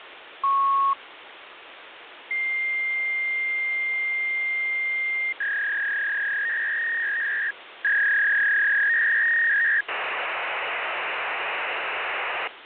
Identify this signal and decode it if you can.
Fax machine handshake, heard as a beep, a long tone, a warble and hiss, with phone line noise.